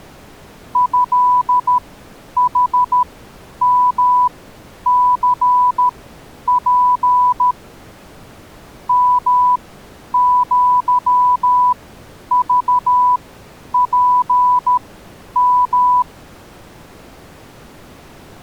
Morse code (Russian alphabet), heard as a keyed tone, machine-sent, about 13 wpm, spaced as for 9 wpm, 990 Hz. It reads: ЭХМЦП МЪЖПМ